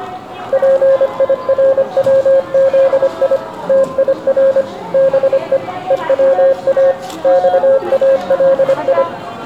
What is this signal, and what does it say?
Morse code (Persian alphabet), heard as a keyed tone, machine-sent, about 25 wpm, 540 Hz, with room echo and the noise of a crowd indoors. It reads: پیروزی تیر به هوا خالی